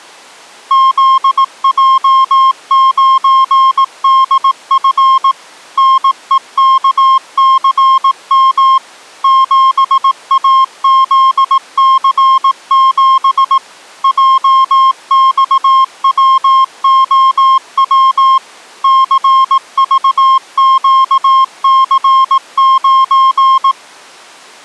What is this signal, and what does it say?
Morse code, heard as a keyed tone, machine-sent, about 18 wpm, 1060 Hz. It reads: ZJ9DF NEKCM 7AZC7 JXWOW CVQC9